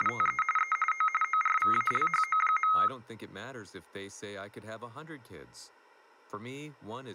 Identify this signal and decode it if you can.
RTTY (45.45 baud, 850 Hz shift), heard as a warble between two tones, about 1700 Hz centre, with speech in English. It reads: … E O ORVALHO.